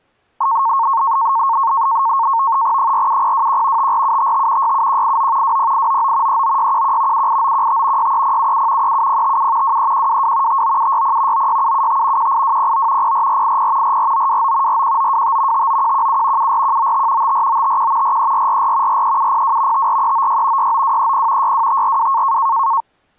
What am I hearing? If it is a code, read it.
NAVTEX (SITOR-B), 100 baud, 170 Hz shift, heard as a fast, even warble, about 1000 Hz centre. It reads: 47021 54755 67189 20899 39611 78915 63077 37057 23122 59760 96775 18209 04480 44929 41925 59117 74195 54951 43444 43702 54396 69230 62542